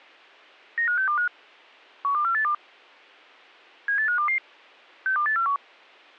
Five-tone selective call (CCIR), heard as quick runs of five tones, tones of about 100 ms. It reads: 95625 12482 78522 62841